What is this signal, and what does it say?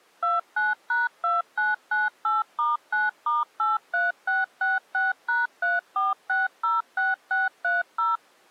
DTMF, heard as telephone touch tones, dialled by machine, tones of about 170 ms. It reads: 29#2998*9*83666#34606630